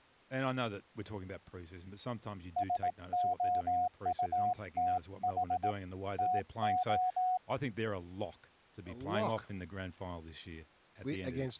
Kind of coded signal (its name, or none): Morse code